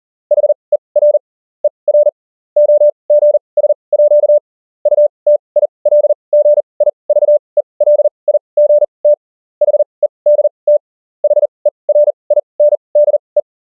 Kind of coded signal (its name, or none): Morse code